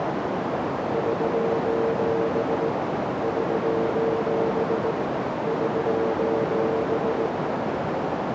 Morse code, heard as a keyed tone, hand-sent with a straight key, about 18 wpm, 450 Hz, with heavy radio static and a narrow filter. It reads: <SOS> <SOS> <SOS>